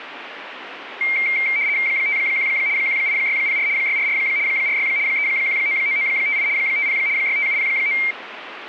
RTTY (75 baud, 170 Hz shift), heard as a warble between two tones, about 2200 Hz centre, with radio static. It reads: 51 18604 644 46 3199958 50 65709